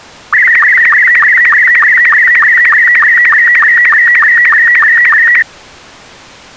SSTV (slow-scan television), Robot 72, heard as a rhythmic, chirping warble.